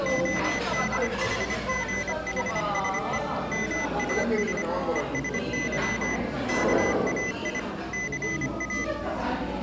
Morse code (Greek alphabet), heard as a high beeper, machine-sent, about 25 wpm, 2000 Hz, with the noise of a crowd indoors. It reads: ΟΔΗΓΗΣΕ ΜΑΣ ΕΣΥ ΚΑΙ ΘΑ